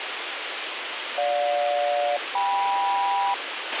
Aircraft SELCAL, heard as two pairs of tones, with radio hiss and a squelch burst at the end. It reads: GJ-KM